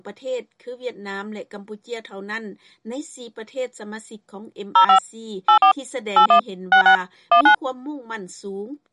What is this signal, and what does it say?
DTMF, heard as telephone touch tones, dialled by machine, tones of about 100 ms. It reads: 05 84 81 66 19